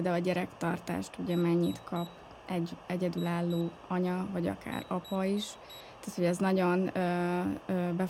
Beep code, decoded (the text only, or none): 3-2-4